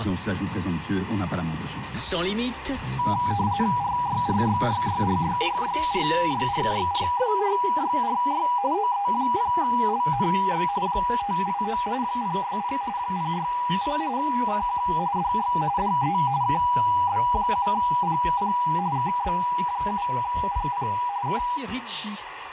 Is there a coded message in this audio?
Yes: RTTY (45.45 baud, 170 Hz shift) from 3.0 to 21.6 s, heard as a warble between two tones, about 890 Hz centre, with radio static. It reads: RYRYRYRYRYRYRYRYRYRY OE0LNX 589 060 060 CQ DX DE KB7PP KB7PP K